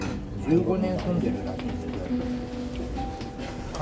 The noise of a restaurant. There is no code.